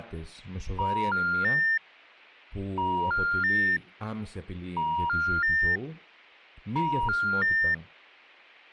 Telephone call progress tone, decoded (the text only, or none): special information tone